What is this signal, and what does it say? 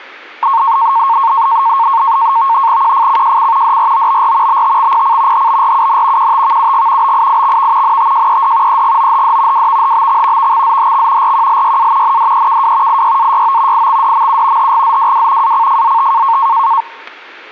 NAVTEX (SITOR-B), 100 baud, 170 Hz shift, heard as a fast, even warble, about 1000 Hz centre, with static crashes. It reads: QFCJC DROBR BTXPC HBRUN QTVUG BIIXV NTJED EGOHD WVHBX VXZHX RQLYA NDEKW IYAYO IXDMU HGZWW ACFZT